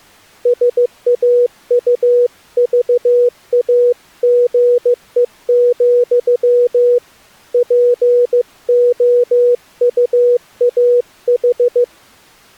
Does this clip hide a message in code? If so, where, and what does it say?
Yes: Morse code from 0.4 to 11.9 s, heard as a keyed tone, hand-sent with a paddle, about 15 wpm, 490 Hz. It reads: SAUVAGE, POUAH